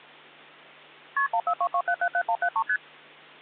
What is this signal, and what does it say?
Multi-frequency trunk signalling (R1, as on North American trunks), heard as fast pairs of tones, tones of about 70 ms, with hum. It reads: KP 1422777173 ST